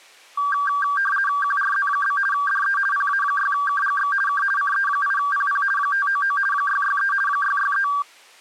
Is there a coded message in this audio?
Yes: RTTY (50 baud, 450 Hz shift) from 0.4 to 8.0 s, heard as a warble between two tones, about 1370 Hz centre. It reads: QRZ? DE PA6KGX K CE8PP 599 663 663